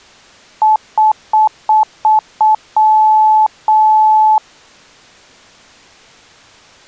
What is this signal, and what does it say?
Beep code, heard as beeps, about 860 Hz. 6 short, 2 long.